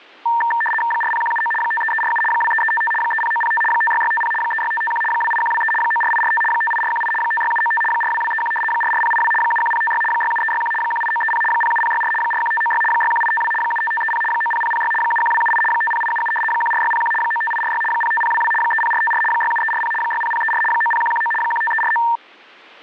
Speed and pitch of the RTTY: 75 baud, 850 Hz shift, 1360 Hz centre

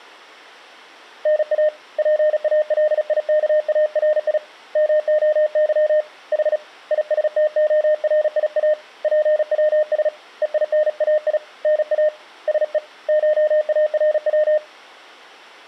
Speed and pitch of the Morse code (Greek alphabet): 36 wpm, 610 Hz

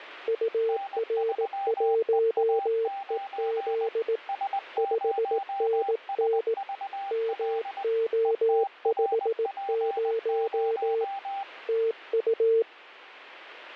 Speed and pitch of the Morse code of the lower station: 18 wpm, 450 Hz

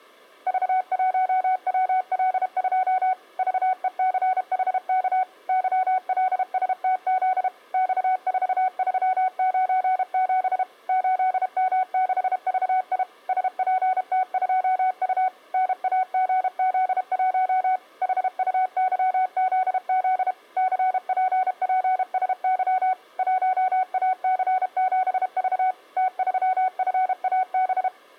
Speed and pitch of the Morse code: 32 wpm, 750 Hz

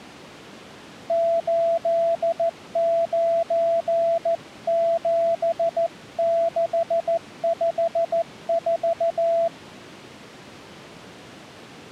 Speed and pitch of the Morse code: 14 wpm, 670 Hz

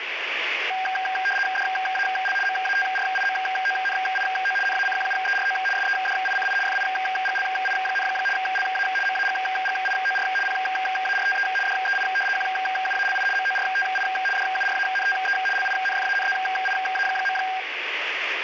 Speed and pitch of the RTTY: 75 baud, 850 Hz shift, 1180 Hz centre

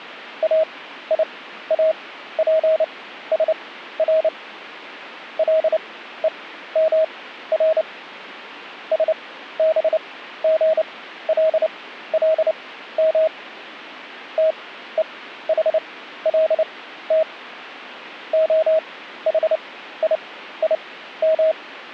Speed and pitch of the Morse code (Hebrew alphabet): 29 wpm, spaced as for 14 wpm, 640 Hz

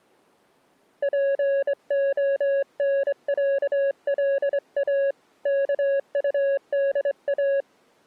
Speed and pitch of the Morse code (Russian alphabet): 25 wpm, 550 Hz

